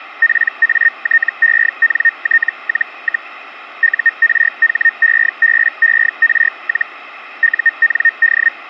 Hellschreiber (Feld-Hell, 122.5 baud), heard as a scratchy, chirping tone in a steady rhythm, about 1850 Hz. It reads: PATENT-, URHEBER- UND